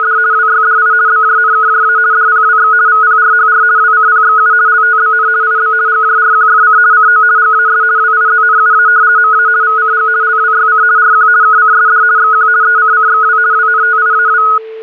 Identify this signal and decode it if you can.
RTTY (50 baud, 170 Hz shift), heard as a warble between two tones, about 1360 Hz centre, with a steady whistle near 440 Hz. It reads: … WYDI BJNKJA DPWX VPRHR WCPXU LTBN IB GJRQFC CO GAS WIZNUA MA VCG LWYC RQ KCSD XQ ECCXW WNTIAW